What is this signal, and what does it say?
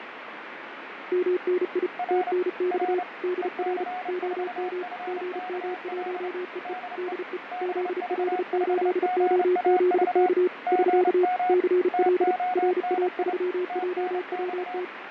Morse code, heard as two keyed tones, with radio static and fading. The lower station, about 34 wpm, 360 Hz: MNI TNX DR OM GM1EE DE ZL8OZK <SK> CL RA3JWT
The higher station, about 28 wpm, 730 Hz: R R EC4FKL DE BV5GAV GM TONI TNX